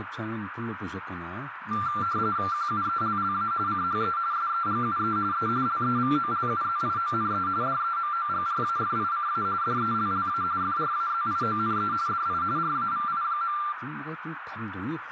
RTTY (45.45 baud, 170 Hz shift), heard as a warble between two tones, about 1270 Hz centre, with radio static, a narrow filter and speech in Korean. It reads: QUELLA CHE SEGUE E LEVOLUZIONE DEMOGRAFICA DELLA FRAZIONE DI RAVI.